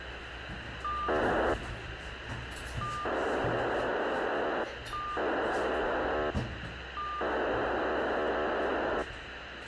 POCSAG pager data (2400 baud), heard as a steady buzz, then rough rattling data, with radio hiss and the noise inside a lift.